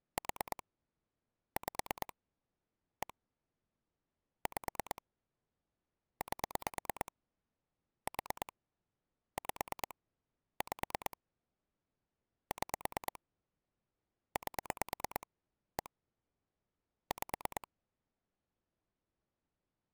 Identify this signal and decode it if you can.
Pulse dialling, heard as clicks on a phone line, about 9 pulses a second. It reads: 4 5 1 5 8 4 5 5 6 8 1 5